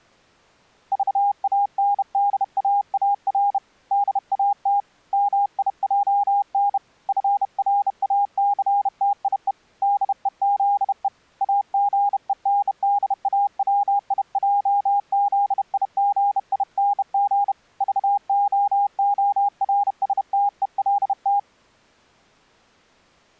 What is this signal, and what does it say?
Morse code, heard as a keyed tone, hand-sent with a bug key, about 31 wpm, 810 Hz. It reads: VANDAAR DAT MIJN FRACTIE DEZE AGENDAWIJZIGING VOORSTELT